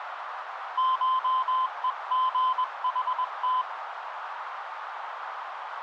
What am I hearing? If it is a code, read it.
Morse code (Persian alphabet), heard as a keyed tone, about 21 wpm, 1030 Hz, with radio static and a narrow filter. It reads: شهژحت